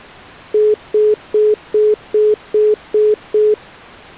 Telephone call progress tone (single-tone plan, as in most of Europe), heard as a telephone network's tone, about 420 Hz, 0.2 s on and 0.2 s off. Congestion tone.